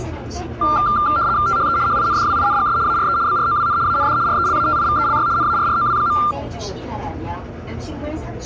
RTTY (75 baud, 170 Hz shift), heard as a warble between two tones, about 1280 Hz centre, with the noise inside a subway train. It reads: THE HINDWINGS ARE BROWN AND RELATIVELY NARROW.